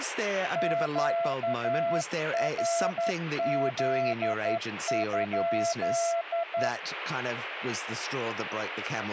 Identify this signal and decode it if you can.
Morse code, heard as a keyed tone, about 11 wpm, 680 Hz, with radio static and speech in English. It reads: QRZ?